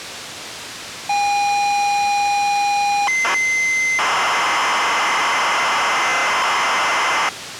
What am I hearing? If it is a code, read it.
ZX Spectrum tape loading, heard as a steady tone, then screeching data, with tape hiss.